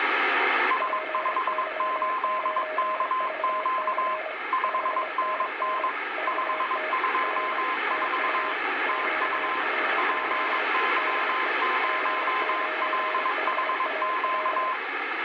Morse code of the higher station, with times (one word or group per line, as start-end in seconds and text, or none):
0.7-4.1 S58KQ
4.5-5.9 5NN
6.3-8.5 524
8.9-9.6 TU
10.0-14.7 PY0LHQ